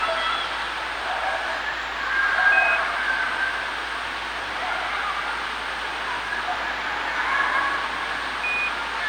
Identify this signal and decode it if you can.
Quindar tones, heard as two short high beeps, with radio hiss and the noise of a residential street.